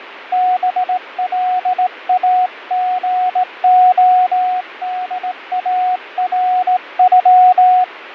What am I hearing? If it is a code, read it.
Morse code (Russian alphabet), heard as a keyed tone, hand-sent with a straight key, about 18 wpm, 730 Hz, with radio static and fading. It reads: БЛАГОДАРЮ